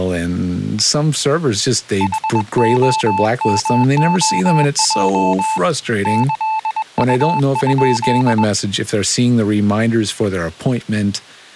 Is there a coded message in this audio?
Yes: Morse code (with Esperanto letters) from 1.9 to 8.5 s, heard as a keyed tone, hand-sent with a paddle, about 21 wpm, 880 Hz, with speech in English. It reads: HOMOJ ĈU?